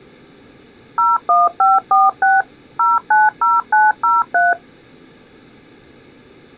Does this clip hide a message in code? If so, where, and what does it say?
Yes: DTMF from 1.0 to 4.5 s, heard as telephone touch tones, dialled by machine, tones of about 190 ms. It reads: 01546 090903